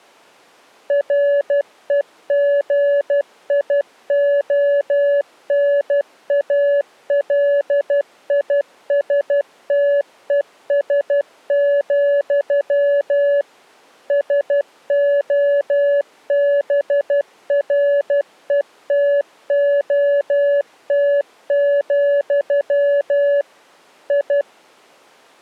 Morse code, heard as a keyed tone, machine-sent, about 12 wpm, 570 Hz. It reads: REGIONALISTES, SOBRETOT, I